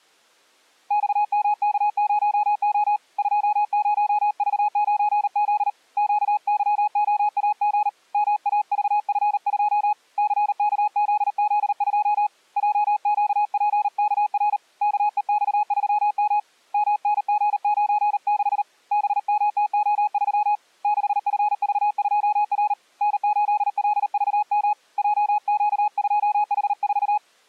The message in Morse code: XMK0O 20V9Z QYOAG MAVF2 CKZZ2 JQPKR KEX3M MNG96 BMTO3 6FV2R N8LVM JQ2H4

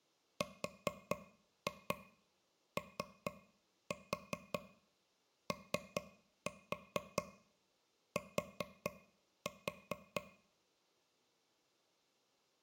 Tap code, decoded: ROOT

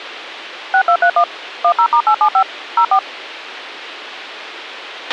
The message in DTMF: 6231 10*875 04

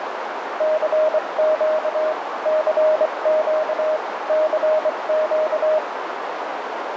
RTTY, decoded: none

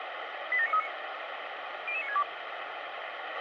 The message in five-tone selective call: 87939 00962

